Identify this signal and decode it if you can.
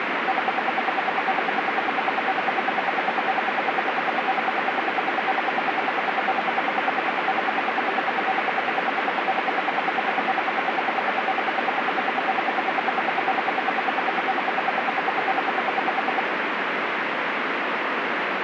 Radio time signal (RWM, Moscow), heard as ten pulses a second, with radio static.